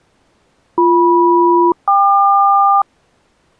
Aircraft SELCAL, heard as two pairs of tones. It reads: BM-KQ